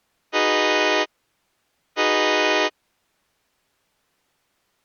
Train horn signal, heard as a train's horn. 2 short. On North American railways: a signal is acknowledged.